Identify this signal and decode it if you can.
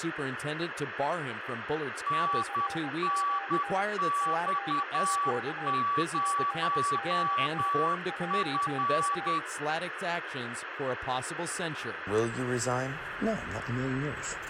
Morse code, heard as two keyed tones, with radio static. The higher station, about 10 wpm, 1140 Hz: NNX0F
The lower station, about 21 wpm, 790 Hz: CQ CQ CQ JA